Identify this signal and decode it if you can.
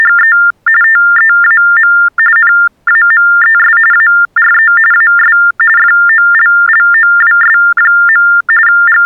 TTY/TDD text telephone tones (45.45 baud Baudot), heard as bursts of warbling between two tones, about 400 Hz shift, 1600 Hz centre. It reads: … TEAM NAMES ARE AS FOLLOWS. …